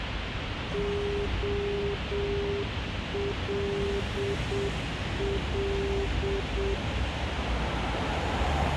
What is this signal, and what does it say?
Morse code, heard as a keyed tone, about 7 wpm, 400 Hz, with radio hiss and street noise. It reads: OLL